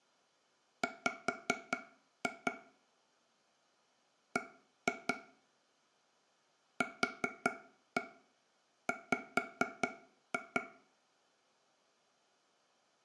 Tap code, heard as taps on a table, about 4 knocks a second, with room echo. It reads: W B QW